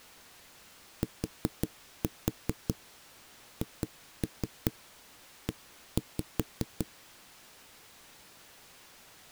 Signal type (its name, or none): tap code